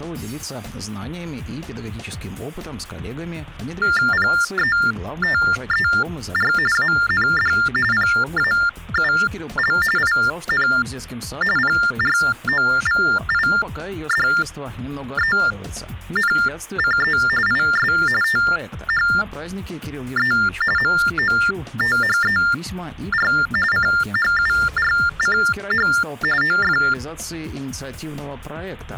TTY/TDD text telephone tones (45.45 baud Baudot), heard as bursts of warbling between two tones, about 400 Hz shift, 1600 Hz centre. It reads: PETER AND PAUL IN PROVIDENCE IS THE MOTHER CHURCH OF